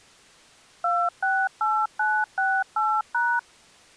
DTMF, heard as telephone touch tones, dialled by machine, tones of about 250 ms. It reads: 268968#